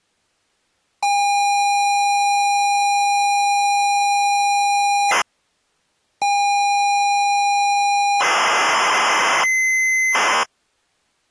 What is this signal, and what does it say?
ZX Spectrum tape loading, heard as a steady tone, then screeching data.